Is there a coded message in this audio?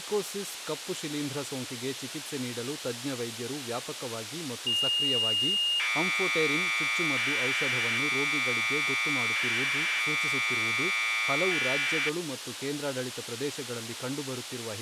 Yes: Commodore tape loading (standard loader) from 4.7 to 12.1 s, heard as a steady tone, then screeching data, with tape hiss and speech in Kannada.